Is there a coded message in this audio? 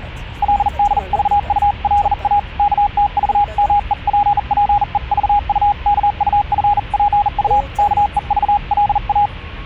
Yes: Morse code (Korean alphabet) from 0.4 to 9.3 s, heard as a keyed tone, hand-sent with a bug key, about 40 wpm, 820 Hz, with the noise inside a car. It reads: 그리고 얼마짜리인지 알고